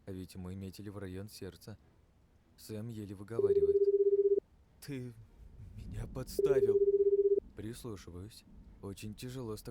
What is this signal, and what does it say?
Telephone call progress tone (Japanese plan), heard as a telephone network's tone, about 380, 400, 420 Hz, 1 s on and 2 s off. Ringback tone.